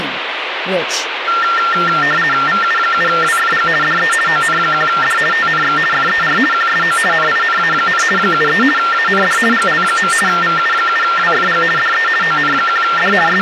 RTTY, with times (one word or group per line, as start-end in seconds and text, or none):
2.5-3.7 VU7WFG
3.8-4.1 DE
4.3-5.2 ON1D
5.3-5.8 TNX
5.9-6.4 FER
6.5-7.0 QSO
7.1-8.0 NINA,
8.2-8.6 73
8.8-9.4 AND
9.5-10.1 GL.
10.3-11.6 VU7WFG
11.8-12.1 DE
12.2-13.1 ON1D
13.3-13.4 …